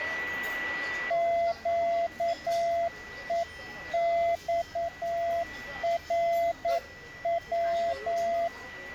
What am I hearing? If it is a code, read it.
Morse code, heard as a keyed tone, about 9 wpm, 680 Hz, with a steady whistle near 1960 Hz and the noise of a crowd indoors. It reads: QEXRW